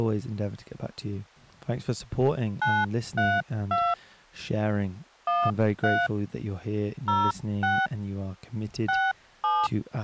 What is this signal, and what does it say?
DTMF, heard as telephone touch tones, dialled by hand, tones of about 230 ms, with speech in English. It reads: 932 13 06 67